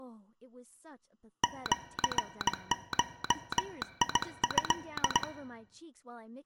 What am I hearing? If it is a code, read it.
Morse code (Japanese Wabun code), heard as a telegraph sounder, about 18 wpm, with speech in English. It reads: シゴト